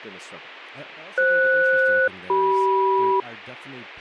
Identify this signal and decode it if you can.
Aircraft SELCAL, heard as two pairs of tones, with a squelch burst at the end and speech in English. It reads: FS-CM